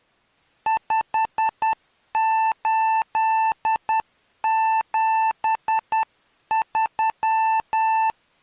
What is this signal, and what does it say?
Morse code, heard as a keyed tone, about 10 wpm, 890 Hz. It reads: 5873